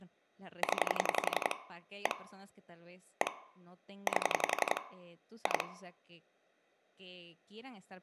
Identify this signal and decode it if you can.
Pulse dialling, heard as clicks on a phone line, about 11 pulses a second, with room echo and speech in Spanish. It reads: 0 1 1 8 2